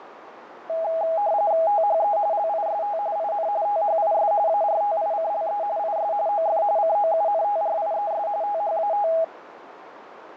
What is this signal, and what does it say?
RTTY (45.45 baud, 170 Hz shift), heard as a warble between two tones, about 740 Hz centre, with radio static and a narrow filter. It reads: THE LIST IN THIS ARTICLE IS OF COUNTRIES THAT